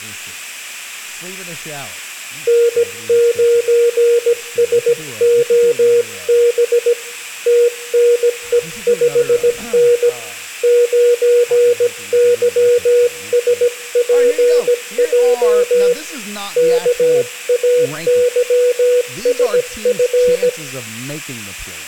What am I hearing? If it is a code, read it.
Morse code, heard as a keyed tone, hand-sent with a paddle, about 17 wpm, 480 Hz, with room echo and speech in English. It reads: N9SOB TNE5N 9YSPJ KAYSF